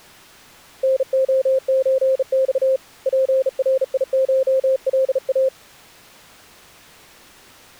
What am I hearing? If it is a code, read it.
Morse code (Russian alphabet), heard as a keyed tone, hand-sent with a bug key, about 36 wpm, 530 Hz. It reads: НОЧЬ ПРИШЛА